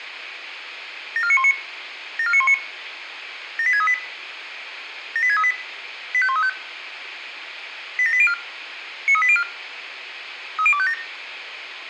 Five-tone selective call (ZVEI), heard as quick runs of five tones, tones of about 70 ms, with radio hiss, a squelch burst at the end and room echo. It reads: 74919 74919 78638 78638 85135 87804 93804 30257